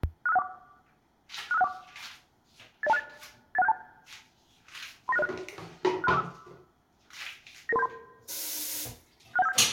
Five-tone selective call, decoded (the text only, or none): 65614 65614 80268 81672 39606 63645 99373 61757